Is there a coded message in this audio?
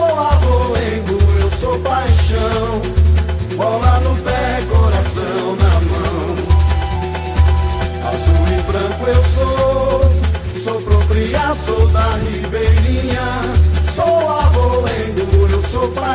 No.